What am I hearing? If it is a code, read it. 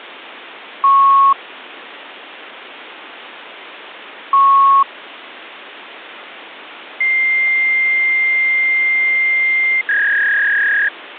Fax machine handshake, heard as beeps, a long tone and a warble, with phone line noise.